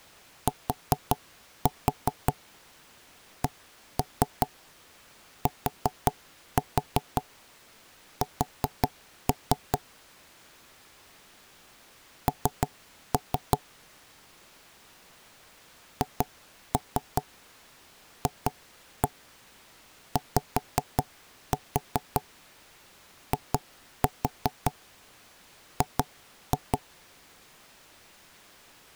Tap code, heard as knocks on wood, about 5 knocks a second. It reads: TCTS N HFYIG